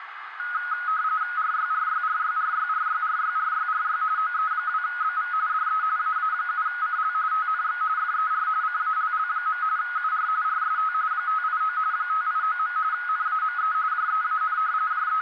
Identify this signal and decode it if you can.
RTTY (45.45 baud, 170 Hz shift), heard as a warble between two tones, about 1360 Hz centre, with radio static and a narrow filter. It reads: RYRYRYRYRYRYRYRY OE2BV DE AA7CL TNX FER CALL. UR RST 589 589. NAME JEAN …